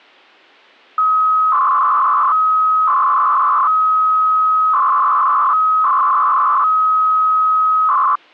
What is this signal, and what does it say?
300-baud modem data (Bell 103 tones), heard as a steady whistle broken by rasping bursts, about 300 baud, 200 Hz shift.